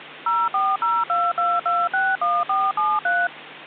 DTMF, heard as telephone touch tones, dialled by machine, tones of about 220 ms, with phone line noise and hum. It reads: 04022261473